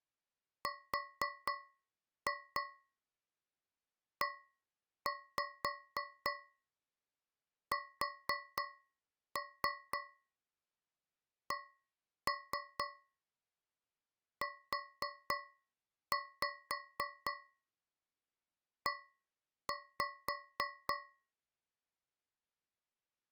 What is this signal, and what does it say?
Tap code, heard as taps on a metal pipe, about 3 knocks a second. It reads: RESCUE